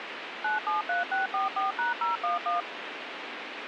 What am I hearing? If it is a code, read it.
DTMF, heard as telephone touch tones, dialled by machine, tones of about 150 ms, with radio hiss. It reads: 973644#011